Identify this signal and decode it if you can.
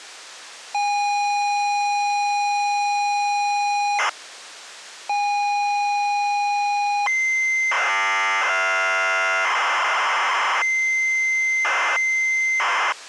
ZX Spectrum tape loading, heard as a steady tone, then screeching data.